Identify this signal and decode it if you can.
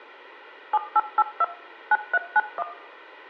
DTMF, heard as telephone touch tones, dialled by machine, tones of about 40 ms, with room echo. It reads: 7882 9391